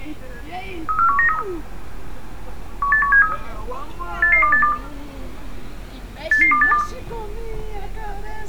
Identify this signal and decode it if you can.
Five-tone selective call (CCIR), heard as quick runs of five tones, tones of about 100 ms, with room echo and street noise. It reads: 34193 18173 88282 88282